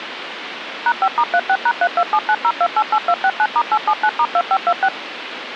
DTMF, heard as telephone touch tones, dialled by machine, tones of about 60 ms, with phone line noise. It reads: #5*36#32790288269*879*2526